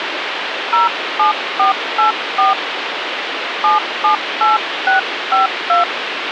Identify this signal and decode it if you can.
DTMF, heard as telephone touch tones, dialled by hand, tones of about 150 ms, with phone line noise. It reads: 07484 778652